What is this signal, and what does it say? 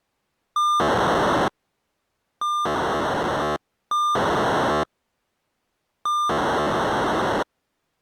POCSAG pager data (2400 baud), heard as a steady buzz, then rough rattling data.